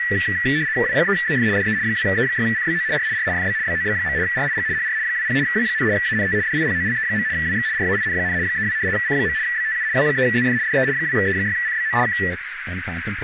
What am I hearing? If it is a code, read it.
RTTY (75 baud, 170 Hz shift), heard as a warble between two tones, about 1850 Hz centre, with radio static, a narrow filter and speech in English. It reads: W3ZF DE 2E6CBO R R FB BOB. RIG HR 20 W, ANT DIPOLE. WX RAIN, 32 C. BTU W3ZF DE 2E6CBO K